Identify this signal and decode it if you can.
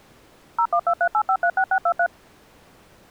DTMF, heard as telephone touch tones, dialled by machine, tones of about 70 ms. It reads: 01238536623